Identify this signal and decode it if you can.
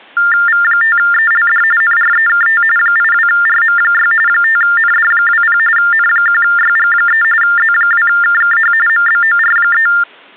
TTY/TDD text telephone tones (45.45 baud Baudot), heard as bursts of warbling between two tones, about 400 Hz shift, 1600 Hz centre. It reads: V5ELD NREKT 82RM6 5ND20 N1YG3 Z2KKH MBOR3